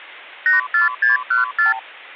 Multi-frequency trunk signalling (R2, with the far end's replies), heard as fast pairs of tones, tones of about 140 ms. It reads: 84614